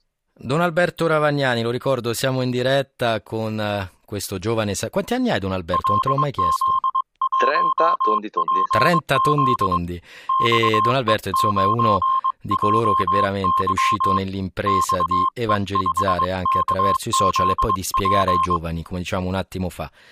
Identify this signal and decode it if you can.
Morse code, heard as a keyed tone, hand-sent with a paddle, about 22 wpm, 1060 Hz, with speech in Italian. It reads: LZ1PZ XE9JY XE5KZP